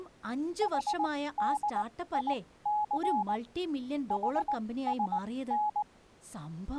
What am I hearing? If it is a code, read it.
Morse code (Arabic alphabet), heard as a keyed tone, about 19 wpm, spaced as for 15 wpm, 840 Hz, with speech in Malayalam. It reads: حديث حسن